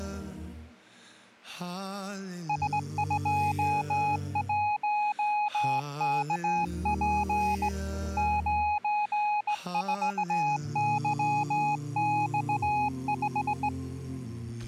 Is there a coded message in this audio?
Yes: Morse code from 2.4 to 13.7 s, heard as a keyed tone, hand-sent with a straight key, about 18 wpm, 840 Hz. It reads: S21KP 94YX5